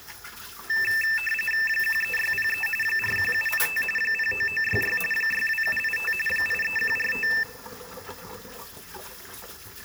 RTTY (45.45 baud, 850 Hz shift), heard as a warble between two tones, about 2200 Hz centre, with kitchen noise. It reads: 13603 41785 09966 62785 83145